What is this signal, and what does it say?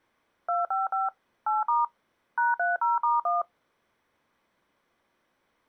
DTMF, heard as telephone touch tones, dialled by machine, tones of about 170 ms. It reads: 255 8* #30*1